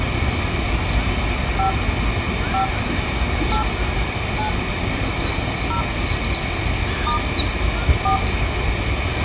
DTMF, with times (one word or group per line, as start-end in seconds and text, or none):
1.6-1.7 5
2.5-2.6 5
3.5-3.6 8
4.4-4.5 9
5.7-5.8 0
7.1-7.2 *
8.0-8.2 4